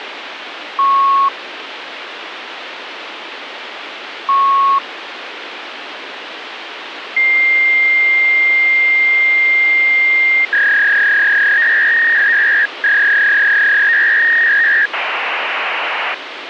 Fax machine handshake, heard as beeps, a long tone, a warble and hiss, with phone line noise.